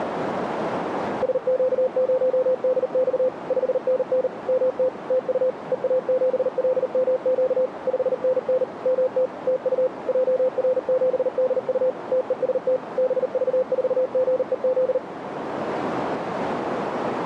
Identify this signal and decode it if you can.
Morse code, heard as a keyed tone, machine-sent, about 39 wpm, 510 Hz, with radio static and a narrow filter. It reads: SQ0DX 5NN MT TU EA7LMQ 5NN MT TU JR7DU TEST BV4GEZ